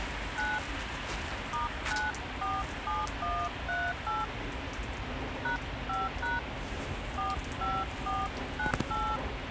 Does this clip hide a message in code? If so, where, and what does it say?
Yes: DTMF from 0.4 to 9.2 s, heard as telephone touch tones, dialled by hand, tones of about 180 ms, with radio hiss, a squelch burst at the end and street noise. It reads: 9 *947138 #5# 45498